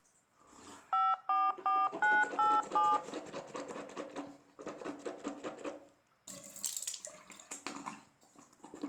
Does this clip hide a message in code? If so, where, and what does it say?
Yes: DTMF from 0.9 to 3.0 s, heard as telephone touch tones, dialled by machine, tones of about 220 ms, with the noise of a restroom. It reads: 544987